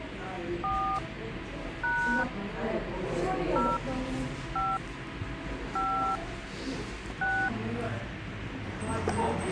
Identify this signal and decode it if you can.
DTMF, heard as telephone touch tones, dialled by hand, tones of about 290 ms, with radio hiss, a squelch burst at the end and the noise of a cafe. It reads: 4 # 0 5 5 6